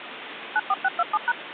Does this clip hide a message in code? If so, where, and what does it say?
Yes: DTMF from 0.6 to 1.3 s, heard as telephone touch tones, dialled by machine, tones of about 40 ms, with phone line noise. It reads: 94627#